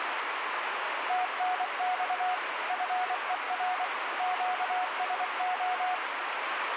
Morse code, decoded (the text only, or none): TNX FER QSO